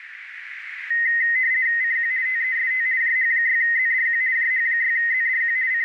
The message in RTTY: CQ TEST JH6ZDQ JH6ZDQ …

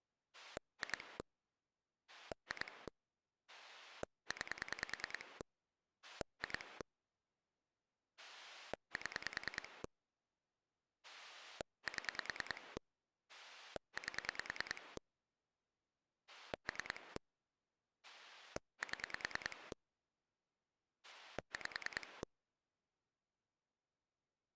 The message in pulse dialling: 2 2 9 2 7 7 8 3 7 5

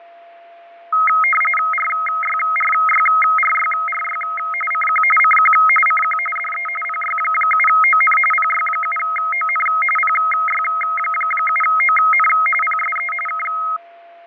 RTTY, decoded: RYRYRYRY CQ CQ CQ DE PY7ON PY7ON PY7ON PSE K

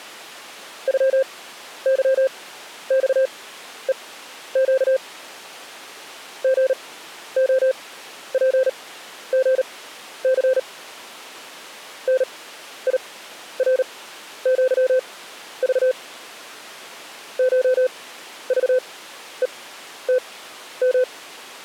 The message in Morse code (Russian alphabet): ЮЫЬЕЩ ГОПГЦ НИРЪЖ ШЖЕТМ

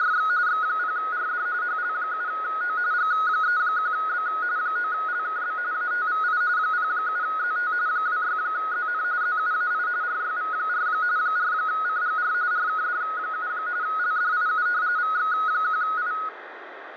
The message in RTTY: … X0RD HL7O G31B 9LKB ATVI 07ZT 26ZN ZUAI RYV4 4CGR RKD7 LDIU VX1I

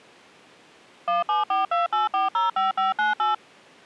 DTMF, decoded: 17428405598

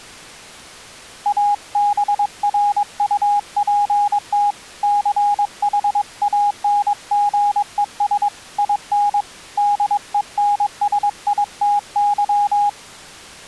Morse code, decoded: ABRUPT CHANGES IN DENSITY

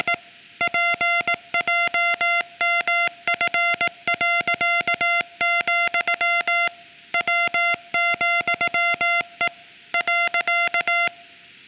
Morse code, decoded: … PJMF., W,E .

